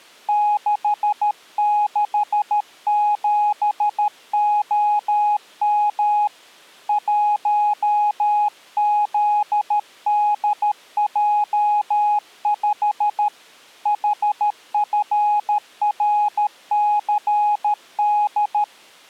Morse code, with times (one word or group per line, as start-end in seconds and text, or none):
0.3-6.3 667OM
6.9-13.3 1ZDJ5
13.9-18.6 HFRCD